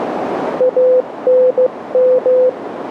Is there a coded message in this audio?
Yes: Morse code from 0.5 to 2.6 s, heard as a keyed tone, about 15 wpm, 510 Hz, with radio static and a narrow filter. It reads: ANM